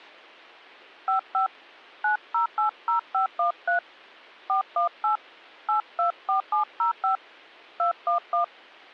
DTMF, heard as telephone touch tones, dialled by hand, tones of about 120 ms. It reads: 55 9080513 418 824705 211